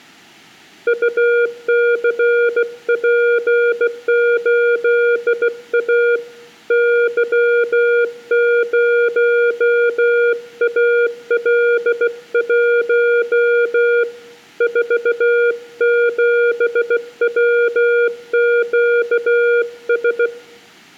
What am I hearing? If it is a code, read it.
Morse code, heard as a keyed tone, hand-sent with a bug key, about 16 wpm, 480 Hz, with room echo. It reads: UCP8A Y0AL1 47WQS